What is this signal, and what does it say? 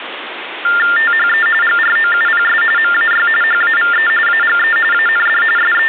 TTY/TDD text telephone tones (45.45 baud Baudot), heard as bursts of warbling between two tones, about 400 Hz shift, 1600 Hz centre, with phone line noise. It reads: THE GROUPS MAY HAVE AGE AND …